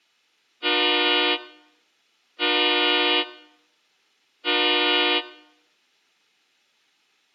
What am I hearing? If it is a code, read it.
Train horn signal, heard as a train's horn. 3 short. On North American railways: when stopped, the train will back up.